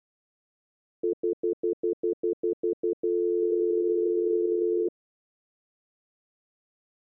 Telephone call progress tone (North American plan), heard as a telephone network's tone, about 350, 440 Hz, 0.1 s on and 0.1 s off. Stutter dial tone.